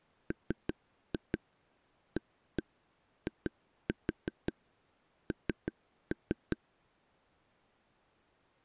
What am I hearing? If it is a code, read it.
Tap code, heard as taps on a table, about 5 knocks a second. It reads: MAIN